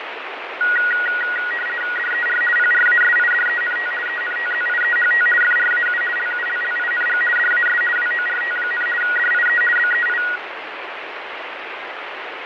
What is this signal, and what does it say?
RTTY (50 baud, 450 Hz shift), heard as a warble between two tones, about 1700 Hz centre, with radio static and fading. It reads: DER PRASIDENT ENTZIEHT FRAU LULLING DAS WORT, DIE BEI